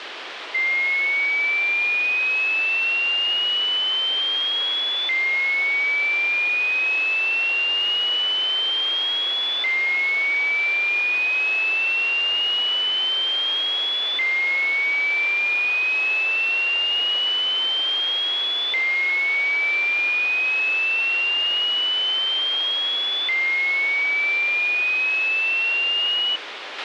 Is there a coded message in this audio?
No, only a tone that sweeps in pitch again and again, with radio hiss and a squelch burst at the end.